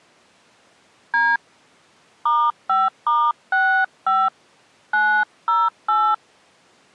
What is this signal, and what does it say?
DTMF, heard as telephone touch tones, dialled by hand, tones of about 250 ms. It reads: D *5*65 908